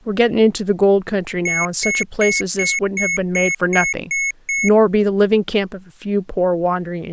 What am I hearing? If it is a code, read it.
Beep code, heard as beeps from a small speaker, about 2200 Hz, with speech in English. 9 short. In AMI BIOS tables: ROM checksum failure.